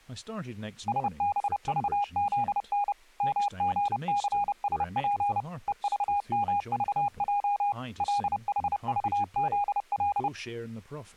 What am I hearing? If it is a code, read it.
Morse code, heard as a keyed tone, machine-sent, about 30 wpm, 820 Hz, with speech in English. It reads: SBVZN MGCSP EVMVJ LHVZL